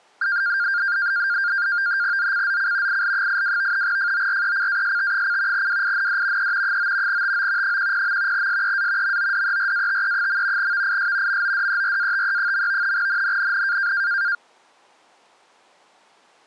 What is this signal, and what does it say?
NAVTEX (SITOR-B), 100 baud, 170 Hz shift, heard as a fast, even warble, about 1500 Hz centre. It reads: ZCZC IL82 FORECAST: WIND E 9 TO 10. SEA MODERATE. VIS MODERATE. NNNN